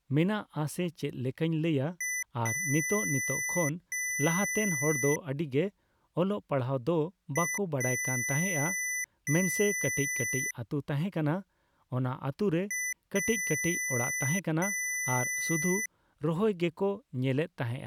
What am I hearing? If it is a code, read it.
Beep code, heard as beeps from a small speaker, played three times, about 2000 Hz, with speech in Santali. 1 short, 2 long.